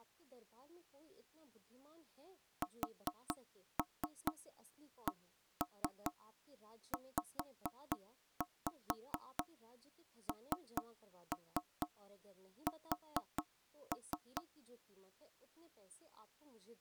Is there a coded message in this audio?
Yes: tap code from 2.6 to 14.5 s, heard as knocks on wood, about 4 knocks a second, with speech in Hindi. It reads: SCZNS